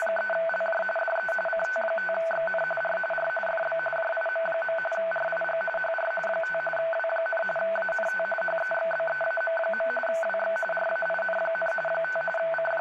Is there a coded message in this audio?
Yes: RTTY (45.45 baud, 850 Hz shift) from 0.0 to 12.8 s, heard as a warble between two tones, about 1080 Hz centre, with radio static and speech in Urdu. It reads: … DE CT5XN R R FB JIM. RIG HR 5 W, ANT HEXBEAM. WX RAIN, 5 …